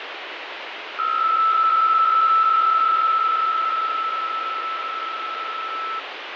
PSK63 (62.5 baud), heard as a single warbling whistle, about 1320 Hz, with radio static and fading.